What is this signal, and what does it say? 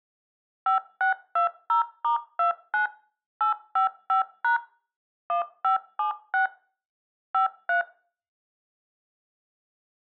DTMF, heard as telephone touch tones, dialled by machine, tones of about 120 ms. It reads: 5620*29 855# 1576 53